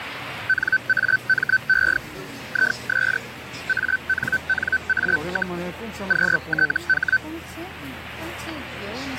Hellschreiber (Feld-Hell, 122.5 baud), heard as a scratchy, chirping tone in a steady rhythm, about 1550 Hz, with the noise of a crowd indoors. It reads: NAME IS ANNA, QTH